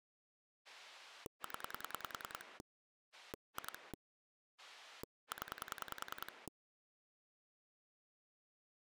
Pulse dialling, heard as a rotary dial, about 10 pulses a second. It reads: 0 2 0